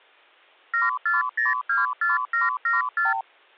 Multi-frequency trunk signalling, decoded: 74024774

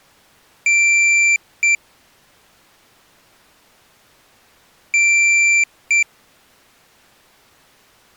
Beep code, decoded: 1 long, 1 short

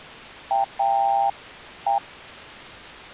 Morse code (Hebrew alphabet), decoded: או

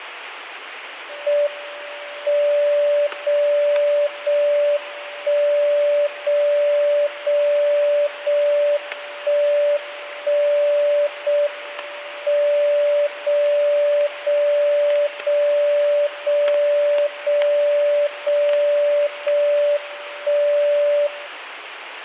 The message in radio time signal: M 0 0 1 0 0 0 1 1 0 M 0 0 0 0 0 0 0 1 0

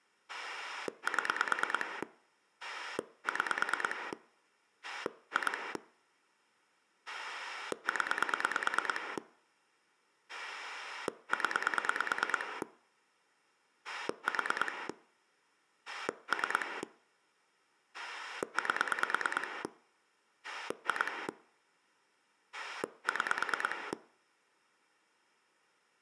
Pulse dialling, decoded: 7 6 2 0 0 4 3 8 2 6

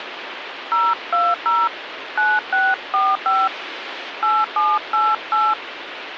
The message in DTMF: 020 9645 8788

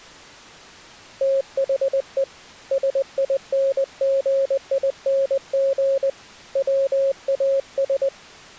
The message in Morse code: THE SINGING WAS

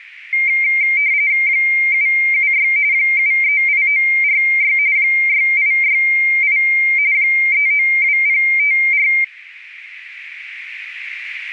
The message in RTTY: 776 738946 6868 392054

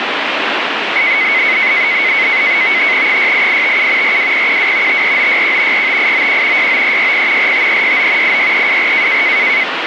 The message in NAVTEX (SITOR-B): 68857 42012 54961 45891 69360 45369 86324

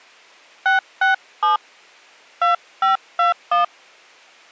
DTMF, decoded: 667 2521

